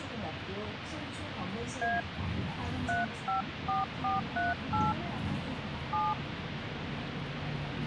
DTMF, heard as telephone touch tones, dialled by hand, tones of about 160 ms, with phone line noise and the noise inside a bus. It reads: A 354438 7